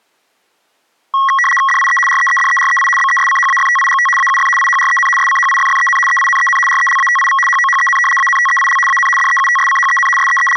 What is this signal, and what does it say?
RTTY (75 baud, 850 Hz shift), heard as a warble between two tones, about 1500 Hz centre. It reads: DIE REEDEREI BESCHAFTIGT AUF IHREN SCHIFFEN EINEN RELATIV HOHEN ANTEIL AN DEUTSCHEN …